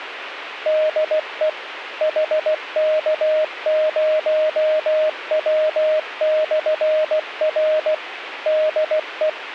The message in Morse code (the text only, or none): DE HK0W/R DE